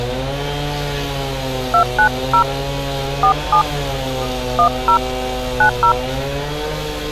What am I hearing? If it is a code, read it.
DTMF, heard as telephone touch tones, dialled by hand, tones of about 90 ms, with street noise. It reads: 290 47 10 90